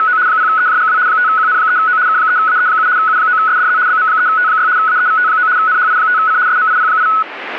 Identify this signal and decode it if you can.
RTTY (75 baud, 170 Hz shift), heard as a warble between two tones, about 1380 Hz centre. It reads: … 0EJGW 5QN3O K3AE7 U9SDZ BM3T6 AEVT9 NHI5C SMIP8